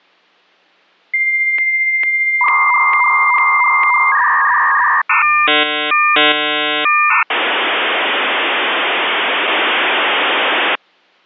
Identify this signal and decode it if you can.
Dial-up modem handshake (V.34 or later), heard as a whistle, warbles, then hiss.